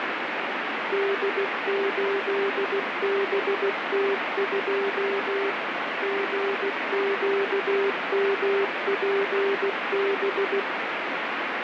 Morse code, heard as a keyed tone, machine-sent, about 16 wpm, 400 Hz, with heavy radio static. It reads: D8BT2 GQMPB